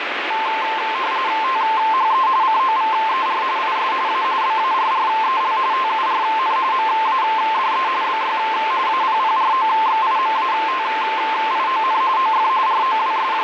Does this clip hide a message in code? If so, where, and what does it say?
Yes: RTTY (45.45 baud, 170 Hz shift) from 0.3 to 13.4 s, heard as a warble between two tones, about 970 Hz centre, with radio static. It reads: THE COVER IS A BARREL TURN MADE BY APPROXIMATION OF …